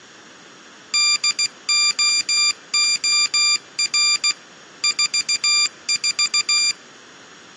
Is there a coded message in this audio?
Yes: Morse code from 0.9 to 6.8 s, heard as a high beeper, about 16 wpm, 2400 Hz. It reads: DOOR 44